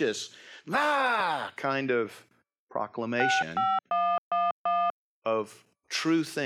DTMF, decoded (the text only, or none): 65111